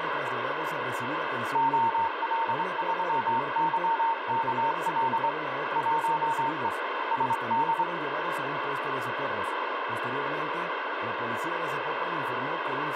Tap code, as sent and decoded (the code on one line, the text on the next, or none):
none